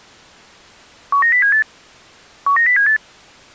Five-tone selective call (CCIR), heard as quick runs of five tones, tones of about 100 ms. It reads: 19078 19078